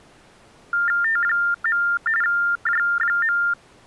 TTY/TDD text telephone tones (45.45 baud Baudot), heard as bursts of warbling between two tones, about 400 Hz shift, 1600 Hz centre. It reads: T. J.